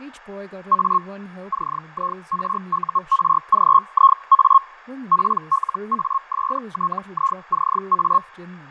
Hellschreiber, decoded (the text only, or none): A CIRURGIA PLASTICA